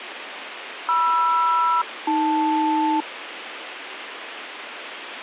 Aircraft SELCAL, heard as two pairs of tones, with radio static. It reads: MR-AL